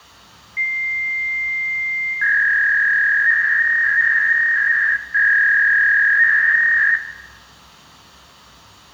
Fax machine handshake, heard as a long tone and a warble, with room echo.